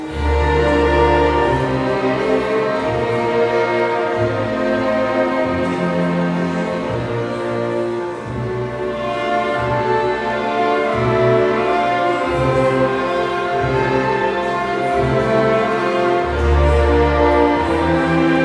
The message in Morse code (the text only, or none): none